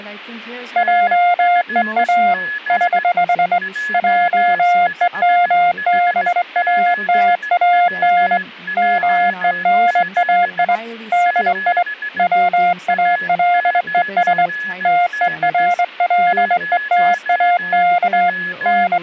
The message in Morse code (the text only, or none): JEA <HH> JEMBATAN MENAI DI WALES TERLETAK …